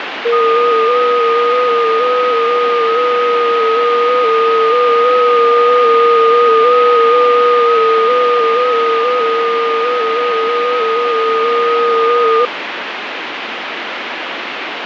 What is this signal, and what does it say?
FT8 (several signals at once), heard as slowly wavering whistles, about 6.25 baud, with radio static.